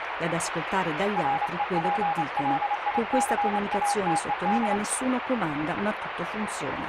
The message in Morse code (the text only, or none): REPLICATED